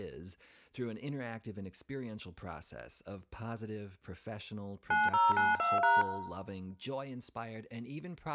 DTMF, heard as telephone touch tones, dialled by machine, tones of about 180 ms, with room echo and speech in English. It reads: 9092#